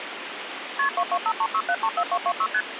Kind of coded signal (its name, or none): multi-frequency trunk signalling